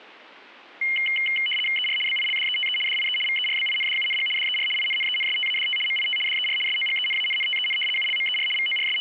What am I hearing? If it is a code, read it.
RTTY (75 baud, 850 Hz shift), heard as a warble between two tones, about 2550 Hz centre. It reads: ER BILDETE DIE VERBINDUNG DER INNENSTADT MIT DER SOGENANNTEN ULMER …